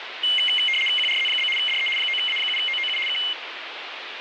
RTTY (75 baud, 850 Hz shift), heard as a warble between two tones, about 2550 Hz centre, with radio static. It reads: QRZ? DE 9A7OOU K